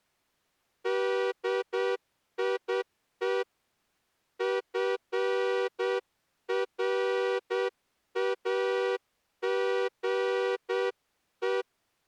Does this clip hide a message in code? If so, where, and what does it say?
Yes: Morse code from 0.8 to 11.7 s, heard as a horn, hand-sent with a straight key, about 8 wpm. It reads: DIE FRAGE